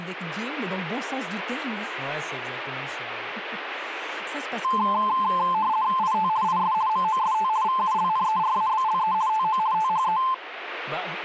RTTY (50 baud, 170 Hz shift), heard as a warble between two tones, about 960 Hz centre, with speech in French. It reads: IT IS MOST VULNERABLE TO THE